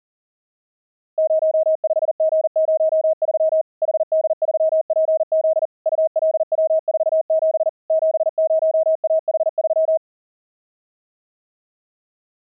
Morse code, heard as a keyed tone, machine-sent, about 40 wpm, 640 Hz. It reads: 05G03 HD3PZ ULW47 70AH3